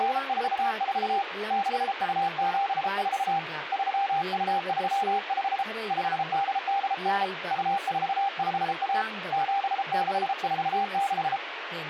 Morse code (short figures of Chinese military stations), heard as a keyed tone, hand-sent with a paddle, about 33 wpm, 790 Hz, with radio static and speech in Manipuri. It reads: … 6274 3235 5889 2451 7646